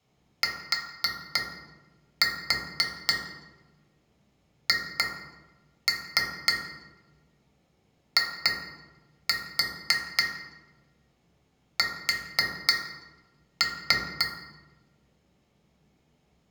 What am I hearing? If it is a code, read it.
Tap code, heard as taps on glass, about 3 knocks a second, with room echo. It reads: THIS